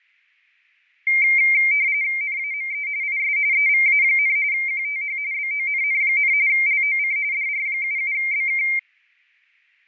RTTY (45.45 baud, 170 Hz shift), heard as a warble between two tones, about 2200 Hz centre, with fading. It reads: NAME IS EVA, QTH BONN, LOC DR77BK